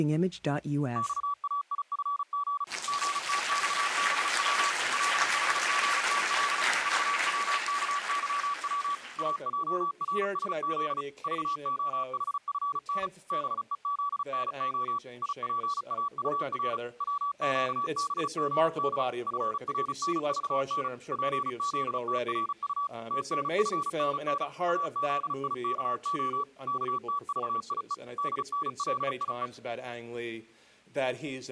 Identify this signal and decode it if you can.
Morse code, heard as a keyed tone, machine-sent, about 35 wpm, 1140 Hz. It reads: XAIFG GTXBW LHGTL VWKYW AJRSZ VOHFN BEZNO IPAUR WQBGD FRNVN PZTRU TNFNN AZIKO KTVIE DNLIE